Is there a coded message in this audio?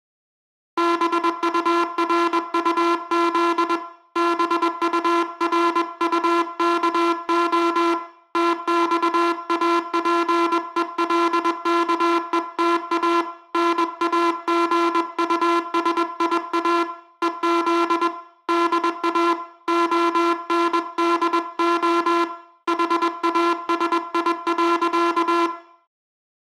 Yes: Morse code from 0.7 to 25.5 s, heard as a buzzer, hand-sent with a paddle, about 21 wpm, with room echo. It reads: BURUZ BURUKO TXAPELKETA NAGUSIA EZ DA ONDO HASI.